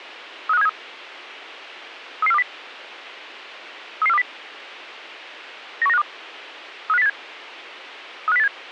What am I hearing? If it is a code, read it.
Five-tone selective call (EEA), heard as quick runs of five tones, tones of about 40 ms. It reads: 35373 33420 33420 91952 35087 35087